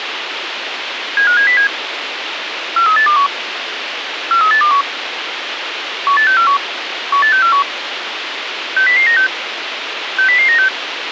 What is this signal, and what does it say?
Five-tone selective call (CCIR), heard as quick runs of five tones, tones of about 100 ms, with radio hiss. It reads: 75707 43821 43821 18641 18641 60096 60096